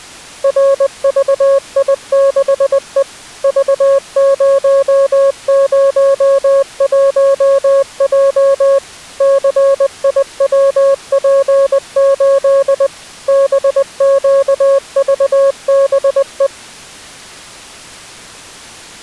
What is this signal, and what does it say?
Morse code, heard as a keyed tone, machine-sent, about 20 wpm, 550 Hz. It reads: RVI6E V001J CIWP8 BQVBE